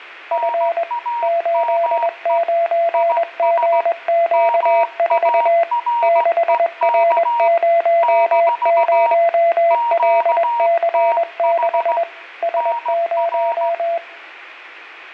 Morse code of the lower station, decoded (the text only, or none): F 89GQ4 6R00LC6 S0